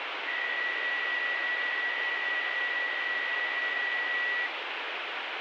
PSK63 (62.5 baud), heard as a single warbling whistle, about 1950 Hz, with radio static.